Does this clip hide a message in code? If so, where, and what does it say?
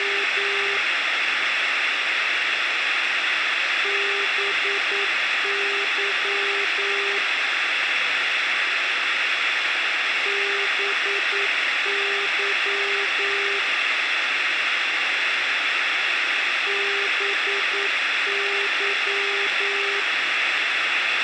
Yes: Morse code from 0.0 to 20.1 s, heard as a keyed tone, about 9 wpm, 400 Hz, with radio hiss and a squelch burst at the end. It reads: … BY BY BY